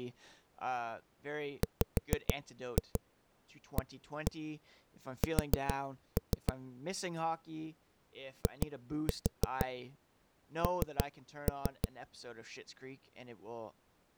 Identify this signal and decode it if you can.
Tap code, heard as knocks on a wall, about 6 knocks a second, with speech in English. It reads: WAS IN